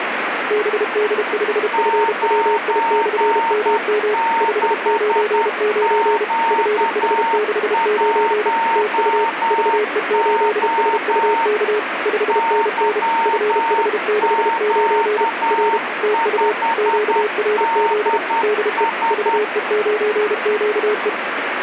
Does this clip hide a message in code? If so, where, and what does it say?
Yes: Morse code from 0.4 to 21.2 s, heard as two keyed tones, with radio static. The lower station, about 32 wpm, 420 Hz: BD5FWI/MM 599 FH69 TU VE8SUK 5NN FH69 R TU QRZ DE VE9QE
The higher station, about 10 wpm, 910 Hz: 96Q1O YQ5DS